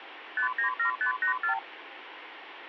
Multi-frequency trunk signalling (R2, with the far end's replies), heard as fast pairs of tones, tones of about 110 ms, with phone line noise. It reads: 597584